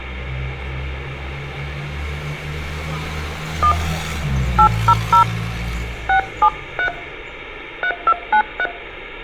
DTMF, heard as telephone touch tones, dialled by hand, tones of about 80 ms, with street noise. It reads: 1 800 673 3293